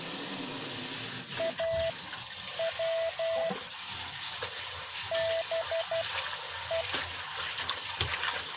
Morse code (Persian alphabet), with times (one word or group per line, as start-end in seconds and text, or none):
1.4-3.5 او
5.1-6.8 به